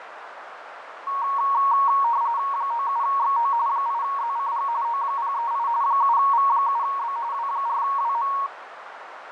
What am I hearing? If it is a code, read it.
RTTY (45.45 baud, 170 Hz shift), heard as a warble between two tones, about 1020 Hz centre, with radio static, fading and a narrow filter. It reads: 97XO 8ZCG O038 7V7B W4WM